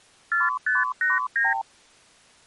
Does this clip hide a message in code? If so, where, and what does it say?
Yes: multi-frequency trunk signalling (R2, with the far end's replies) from 0.3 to 1.6 s, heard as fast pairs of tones, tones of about 170 ms. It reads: 4589